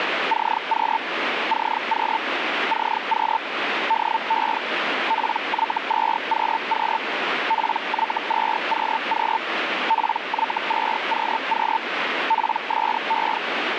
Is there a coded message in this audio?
Yes: Hellschreiber (Feld-Hell, 122.5 baud) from 0.3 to 13.4 s, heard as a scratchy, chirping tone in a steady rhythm, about 900 Hz, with radio static. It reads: CQ CQ CQ DE PY2QQ PY2QQ PY2QQ PSE